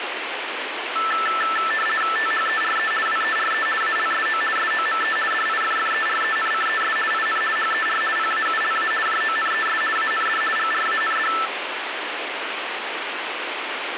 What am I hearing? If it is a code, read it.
RTTY (50 baud, 450 Hz shift), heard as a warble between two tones, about 1550 Hz centre, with radio static. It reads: THERE WERE ALSO SOME DIFFERENCES IN HER PAULA JONES AND GRAND